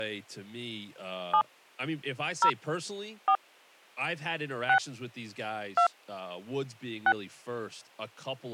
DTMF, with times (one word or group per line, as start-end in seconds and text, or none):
1.3-1.4 7
2.4-2.5 0
3.3-3.4 4
4.7-4.8 6
5.8-5.9 2
7.1-7.1 6